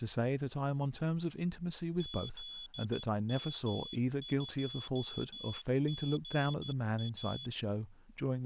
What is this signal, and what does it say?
Morse code, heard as a high beeper, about 13 wpm, 3400 Hz, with speech in English. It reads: ZM2GA